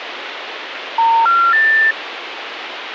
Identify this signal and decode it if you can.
Telephone call progress tone (North American plan), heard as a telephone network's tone, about 910, 1370, 1800 Hz, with phone line noise. Special information tone.